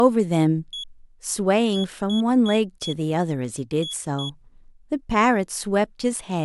Beep code, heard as a piezo beeper, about 3350 Hz, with speech in English. 1-4-2. In Phoenix BIOS tables: parity failure in the first 64 KB of memory.